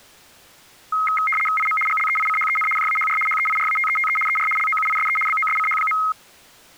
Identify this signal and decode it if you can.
RTTY (75 baud, 850 Hz shift), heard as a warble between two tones, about 1700 Hz centre. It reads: IM GLEICHEN JAHR HEIRATETE ER LOUISE BOSCH.